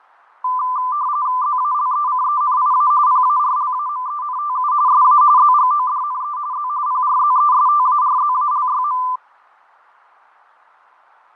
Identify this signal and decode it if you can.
RTTY (45.45 baud, 170 Hz shift), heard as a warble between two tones, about 1100 Hz centre, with fading. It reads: ZALECENIA PARLAMENTU SA ZGODNE Z PRZESTARZALYM